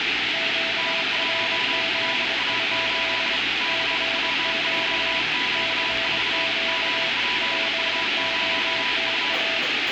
Morse code, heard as two keyed tones, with radio static and the noise of a cafe. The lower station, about 23 wpm, 660 Hz: QRZ? CQ CQ POTA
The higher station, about 33 wpm, 990 Hz: N1RA8 CWJQ4 GPU0U